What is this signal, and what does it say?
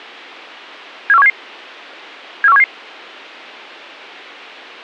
Five-tone selective call (EEA), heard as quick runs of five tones, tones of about 40 ms. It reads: 74177 74177